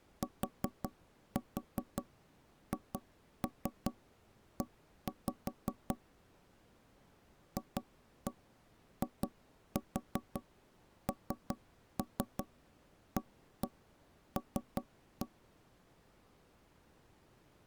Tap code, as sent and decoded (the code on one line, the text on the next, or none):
4-4 2-3 1-5 / 2-1 2-4 3-3 1-1 3-1
THE FINAL